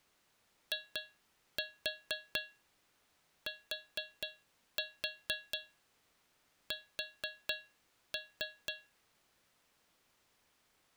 Tap code, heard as taps on a metal pipe, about 4 knocks a second. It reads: ITS